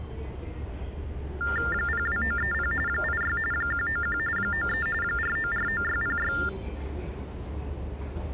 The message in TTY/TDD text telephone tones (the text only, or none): 02930 86 191 93 4949606